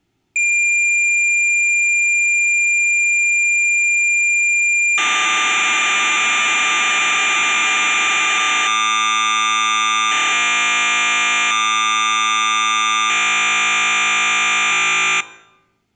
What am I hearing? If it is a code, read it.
Cassette data (Kansas City type), 1200 baud, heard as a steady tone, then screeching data.